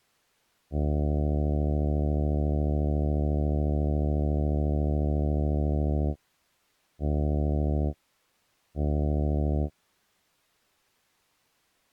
Ship horn signal, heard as a ship's horn, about 70 Hz. 1 long, 2 short. At sea: a vessel in fog that is sailing, fishing, towing or hampered.